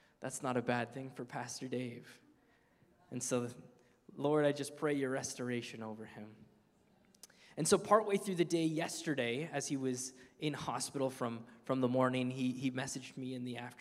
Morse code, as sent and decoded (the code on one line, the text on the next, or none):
none